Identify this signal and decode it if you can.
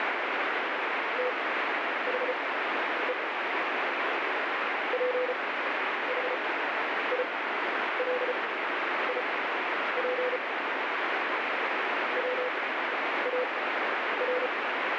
Morse code, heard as a keyed tone, machine-sent, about 34 wpm, spaced as for 10 wpm, 500 Hz, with heavy radio static. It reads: THE PHILIP WAR